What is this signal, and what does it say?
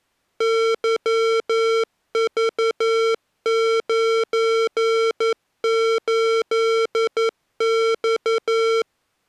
Morse code, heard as electronic beeps, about 11 wpm, 450 Hz. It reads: YV98X